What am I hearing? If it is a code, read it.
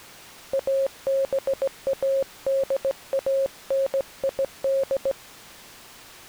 Morse code (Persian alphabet), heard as a keyed tone, hand-sent with a straight key, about 17 wpm, 540 Hz. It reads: ابادانید